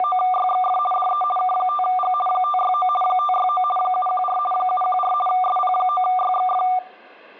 RTTY (50 baud, 450 Hz shift), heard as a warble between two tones, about 960 Hz centre, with room echo. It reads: … DE K5G 569 569 714 714 SP9YXF